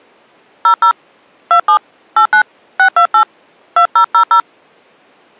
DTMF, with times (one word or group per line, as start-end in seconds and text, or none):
0.7-0.9 00
1.5-1.8 27
2.2-2.4 89
2.8-3.2 628
3.8-4.4 2000